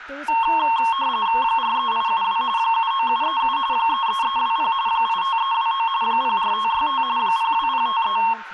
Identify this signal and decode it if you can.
RTTY (45.45 baud, 170 Hz shift), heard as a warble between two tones, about 1000 Hz centre, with room echo and speech in English. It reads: 43872 79737 33320 85329 04565 02053